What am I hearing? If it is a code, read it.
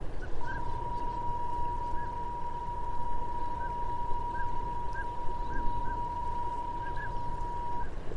PSK31 (31.25 baud), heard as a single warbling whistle, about 960 Hz, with radio static and a narrow filter.